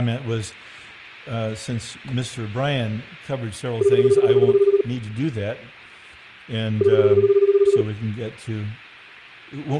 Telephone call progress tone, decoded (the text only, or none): ringback tone